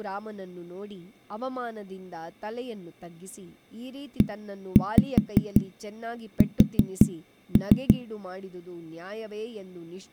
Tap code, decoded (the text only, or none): ES